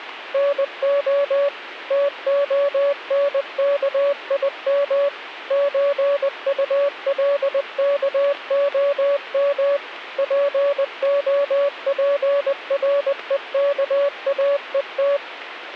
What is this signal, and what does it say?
Morse code (Russian alphabet), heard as a keyed tone, machine-sent, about 20 wpm, 570 Hz, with radio static. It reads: НО ТОНКИМ ЧУЛКОМ ПОПРЕКАЕТ